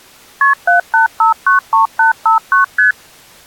Multi-frequency trunk signalling (R1, as on North American trunks), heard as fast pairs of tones, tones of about 130 ms. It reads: KP 78593859 ST